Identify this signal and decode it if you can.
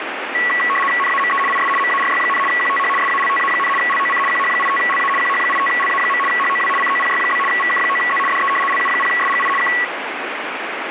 RTTY (75 baud, 850 Hz shift), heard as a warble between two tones, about 1550 Hz centre, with radio static. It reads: NAME IS MARY, QTH SALTA, LOC QH85LA QH85LA. HOW COPY? VK9Z DE LU0SGI K